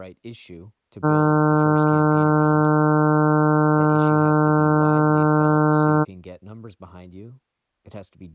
Ship horn signal, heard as a ship's horn, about 150 Hz, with speech in English. 1 long. At sea: a vessel nearing a blind bend, or under power and making way in fog.